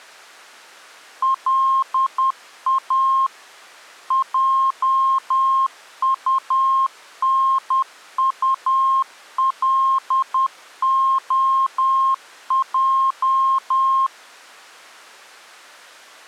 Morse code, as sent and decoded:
.-.. .- / .--- ..- -. ..- .-.. --- .---
LA JUNULOJ

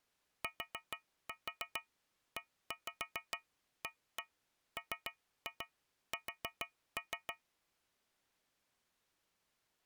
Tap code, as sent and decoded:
4-4 1-5 1-1 3-2 4-3
TEAMS

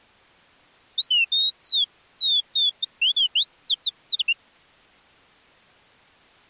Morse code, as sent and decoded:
none

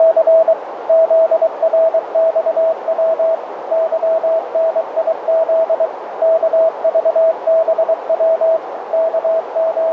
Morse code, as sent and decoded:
… / --.. .-. -..- .-- / -.-- -. .. --.. / -.- ...- -... .-- / …
… ZRXW YNIZ KVBW …

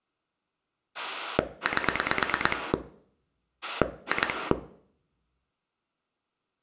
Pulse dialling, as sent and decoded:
8 / 2
8 2

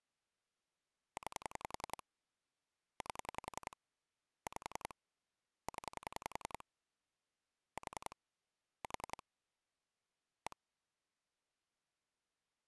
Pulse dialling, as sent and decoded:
9 / 8 / 5 / 10 / 4 / 4 / 1
9 8 5 0 4 4 1

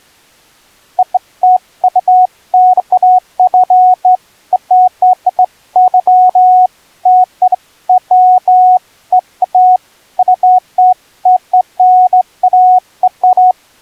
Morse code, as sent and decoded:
none

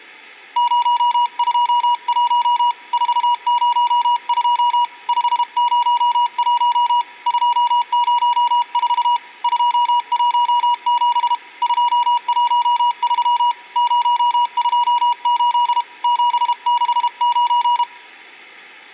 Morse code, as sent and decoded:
----- ..--- .---- / ....- ----- ..--- / ..... ----- .---- / ..--- ----- ....- / ..--- .---- --... / ..--- .---- ...-- / ----- ..--- ---.. / --... -.... ----.
021 402 501 204 217 213 028 769

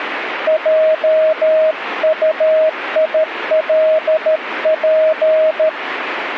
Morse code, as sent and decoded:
.--- ..- .. .-.. .--.
JUILP

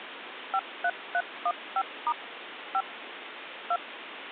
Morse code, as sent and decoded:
none

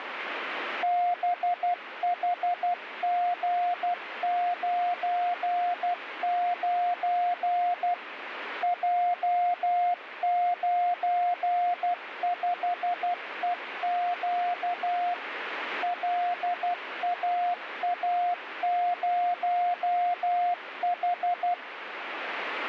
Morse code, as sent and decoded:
-... .... --. ----. ----. / .--- ----. ..... . --.- / .-.. .- .- ----- ....
BHG99 J95EQ LAA0H

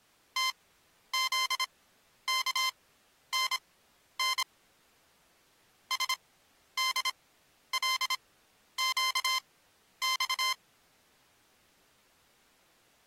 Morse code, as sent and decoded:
- --.. -.- -. -. / ... -.. .-.. --.- -..-
TZKNN SDLQX

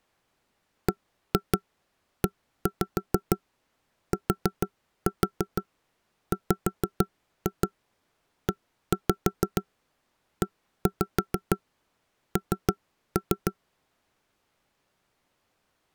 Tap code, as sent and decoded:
1-2 1-5 4-4 5-2 1-5 1-5 3-3
BETWEEN

